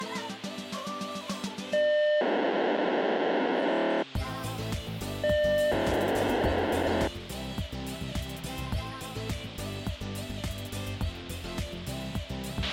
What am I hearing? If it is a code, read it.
POCSAG pager data (1200 baud), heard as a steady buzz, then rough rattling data, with a squelch burst at the end.